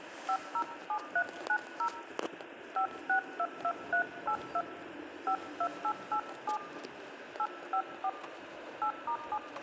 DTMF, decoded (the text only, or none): 507390 5622382 52887 854 8*7